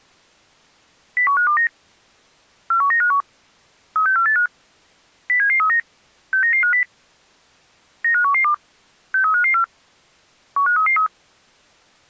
Five-tone selective call (CCIR), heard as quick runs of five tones, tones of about 100 ms. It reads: 01529 41951 36485 07739 69950 95112 63554 15333